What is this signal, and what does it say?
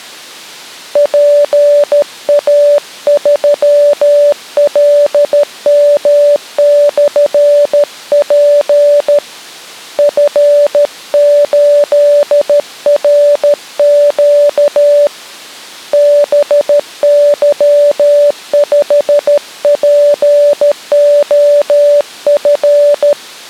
Morse code, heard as a keyed tone, hand-sent with a paddle, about 13 wpm, 580 Hz. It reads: PA3LM/P F8RQ BY5POF